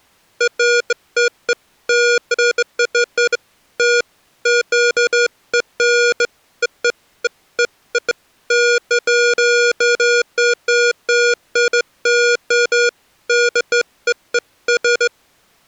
Beeps of irregular length. There is no code.